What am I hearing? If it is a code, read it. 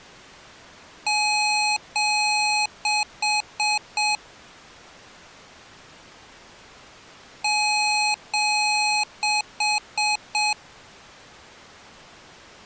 Beep code, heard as beeps from a small speaker, played twice, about 840 Hz. 2 long, 4 short.